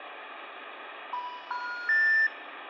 Telephone call progress tone (North American plan), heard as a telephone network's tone, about 980, 1430, 1800 Hz, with phone line noise and room echo. Special information tone.